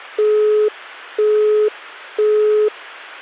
Telephone call progress tone (single-tone plan, as in Europe, Japan and elsewhere), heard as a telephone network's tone, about 420 Hz, 0.5 s on and 0.5 s off. Busy tone.